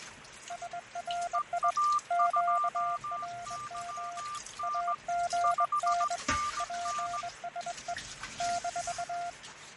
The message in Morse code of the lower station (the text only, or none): SRI QRM AGN PSE -